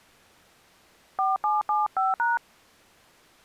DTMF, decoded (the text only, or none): 4775#